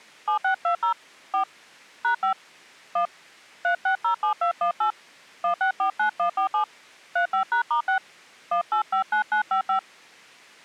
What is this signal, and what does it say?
DTMF, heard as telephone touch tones, dialled by hand, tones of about 100 ms. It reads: 7620 4 #5 1 3607218 1649147 35#*6 1859955